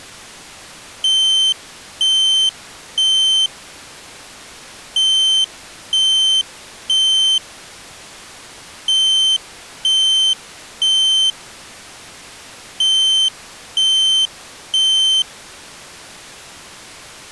Alarm pattern, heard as an alarm's beeps, played four times, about 3100 Hz. Temporal three. Smoke or fire, evacuate.